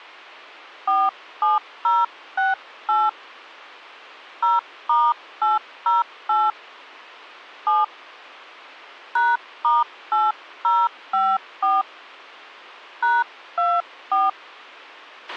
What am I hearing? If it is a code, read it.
DTMF, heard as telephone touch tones, dialled by hand, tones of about 200 ms, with a squelch burst at the end. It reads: 47068 0*808 7 #*8054 #24